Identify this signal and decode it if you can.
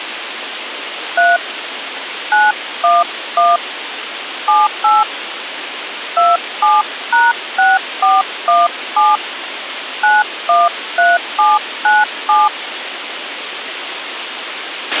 DTMF, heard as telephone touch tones, dialled by hand, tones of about 190 ms, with radio hiss and a squelch burst at the end. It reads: 3 911 78 27#6417 913797